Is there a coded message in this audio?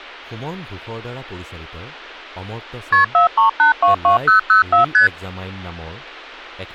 Yes: multi-frequency trunk signalling (R1, as on North American trunks) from 2.9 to 5.1 s, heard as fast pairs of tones, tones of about 120 ms, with speech in Assamese. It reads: KP 43822004 ST